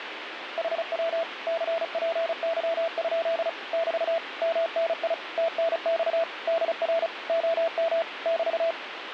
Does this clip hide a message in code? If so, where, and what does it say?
Yes: Morse code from 0.5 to 8.8 s, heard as a keyed tone, machine-sent, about 35 wpm, 660 Hz, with radio static. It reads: HW CPY? <BT> MNI TNX DR OM <BT>